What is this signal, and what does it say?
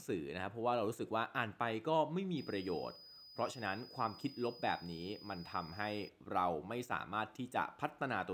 A steady tone, with speech in Thai. There is no code.